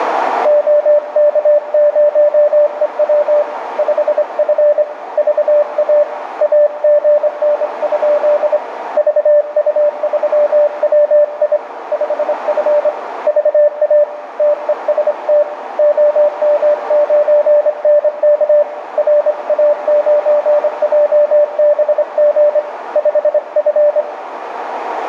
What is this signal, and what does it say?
Morse code, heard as a keyed tone, hand-sent with a straight key, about 25 wpm, 590 Hz, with radio static, a narrow filter and room echo. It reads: OK0EW 5F VA AGN? VU3WI 5F VA TEST OM9NK RA9JBG 5F